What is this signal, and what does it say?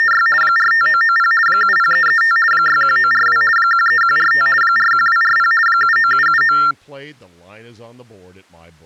RTTY (50 baud, 450 Hz shift), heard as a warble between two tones, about 1600 Hz centre, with speech in English. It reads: … 45990 70335 61942 13145 41240 79779